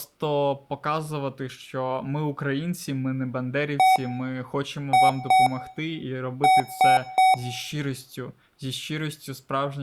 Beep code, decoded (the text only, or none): 1-2-3